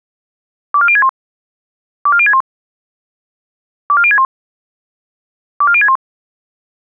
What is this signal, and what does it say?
Five-tone selective call (ZVEI), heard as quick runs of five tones, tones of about 70 ms. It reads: 24061 24061 24061 24061